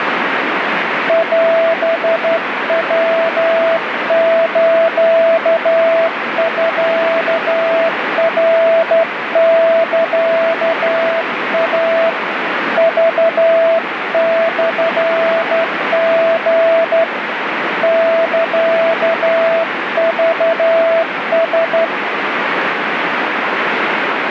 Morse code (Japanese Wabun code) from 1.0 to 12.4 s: オヤスミナサイ

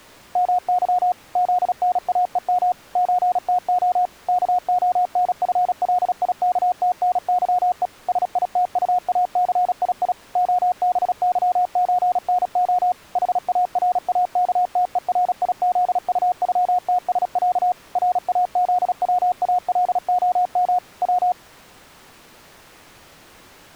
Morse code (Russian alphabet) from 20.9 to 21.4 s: В

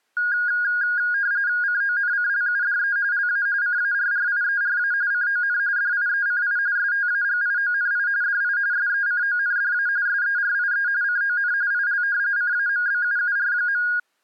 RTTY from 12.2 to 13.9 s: CAMBUUR.

